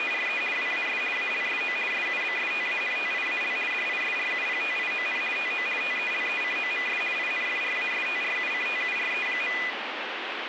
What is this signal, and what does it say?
RTTY (50 baud, 450 Hz shift), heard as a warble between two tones, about 2200 Hz centre, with radio static. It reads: … WAS ALSO SUBSTANTIAL DISRUPTION TO TELECOMS INFRASTRUCTURE.